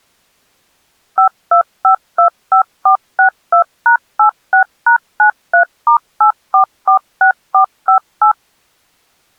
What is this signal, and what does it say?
DTMF, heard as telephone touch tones, dialled by machine, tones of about 100 ms. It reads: 52525462#86#93*8446458